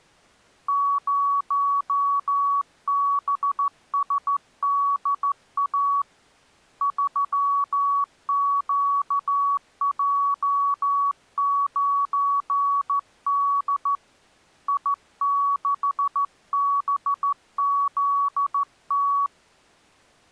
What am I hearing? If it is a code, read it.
Morse code, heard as a keyed tone, hand-sent with a straight key, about 14 wpm, 1130 Hz. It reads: 0BSDA 3QJ9D I6BZT